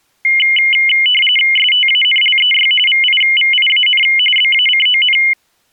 RTTY (45.45 baud, 850 Hz shift), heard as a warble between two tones, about 2550 Hz centre. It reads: STANLEY VIVIAN BACON